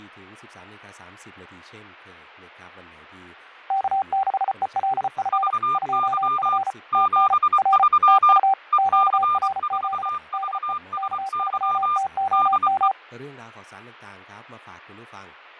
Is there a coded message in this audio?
Yes: Morse code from 3.6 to 13.0 s, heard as two keyed tones, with fading and speech in Thai. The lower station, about 34 wpm, 780 Hz: K6ELF 2F TN R TU QRZ DE K3TOM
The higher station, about 24 wpm, 1200 Hz: VY 73 EC4VSY DE